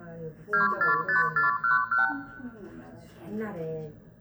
Multi-frequency trunk signalling (R2, with the far end's replies), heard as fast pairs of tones, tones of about 140 ms, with room echo and the noise inside a lift. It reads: 245411